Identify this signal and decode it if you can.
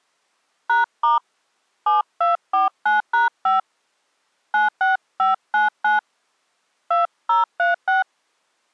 DTMF, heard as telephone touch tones, dialled by hand, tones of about 150 ms. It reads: #* 7249#5 96599 2036